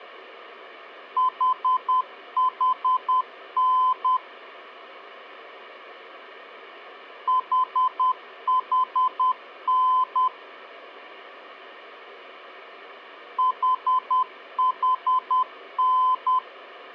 Morse code, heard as a keyed tone, machine-sent, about 10 wpm, 1020 Hz. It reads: HHN HHN HHN